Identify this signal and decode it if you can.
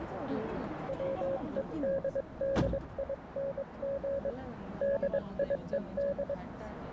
Morse code, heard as a keyed tone, hand-sent with a paddle, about 22 wpm, 550 Hz, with radio static, a narrow filter and the noise inside a subway train. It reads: WEDDING DIED